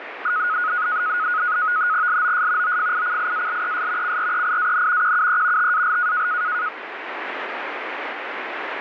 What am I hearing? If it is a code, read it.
NAVTEX (SITOR-B), 100 baud, 170 Hz shift, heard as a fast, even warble, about 1360 Hz centre, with radio static. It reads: LOS OFICIALES CREIAN QUE TAL